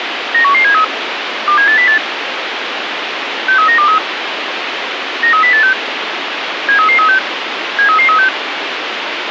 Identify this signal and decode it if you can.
Five-tone selective call (CCIR), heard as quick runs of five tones, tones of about 100 ms, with radio hiss. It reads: 91173 27808 63923 93086 73336 73336